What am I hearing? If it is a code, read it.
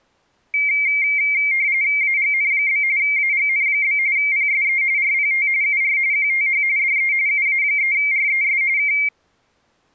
RTTY (45.45 baud, 170 Hz shift), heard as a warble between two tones, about 2200 Hz centre. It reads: AGN? AGN? PSE RPT UR QTH DE UA3RES K